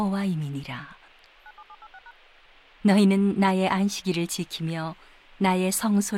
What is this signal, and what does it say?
DTMF, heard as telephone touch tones, dialled by machine, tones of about 50 ms, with radio hiss and speech in Korean. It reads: 97786#